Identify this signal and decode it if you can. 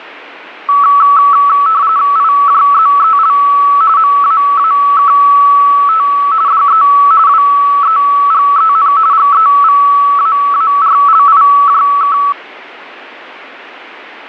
RTTY (45.45 baud, 170 Hz shift), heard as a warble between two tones, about 1220 Hz centre. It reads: IJZEL MAAKT DE WEGEN GEVAARLIJK